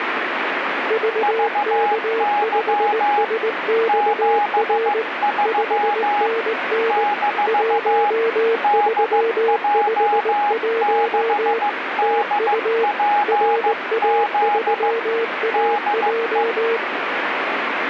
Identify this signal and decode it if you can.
Morse code, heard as two keyed tones, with radio static. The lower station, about 19 wpm, 460 Hz: VK5SXR 5NN 1351 TU RA3AJ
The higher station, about 15 wpm, 830 Hz: VY 73 - DJ6DPZ DE